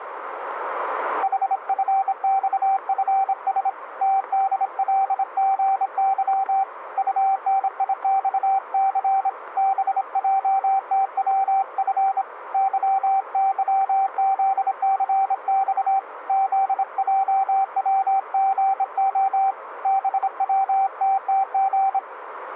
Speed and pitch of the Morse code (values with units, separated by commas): 26 wpm, 780 Hz